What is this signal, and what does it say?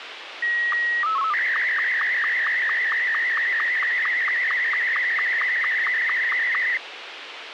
SSTV (slow-scan television), Martin M2, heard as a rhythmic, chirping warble, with radio hiss.